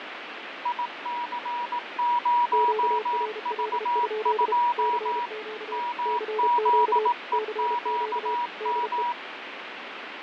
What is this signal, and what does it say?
Morse code, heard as two keyed tones, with radio static and fading. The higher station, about 18 wpm, 960 Hz: IC0V2 MZEQM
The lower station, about 32 wpm, 430 Hz: QRL? CQ CQ CQ DE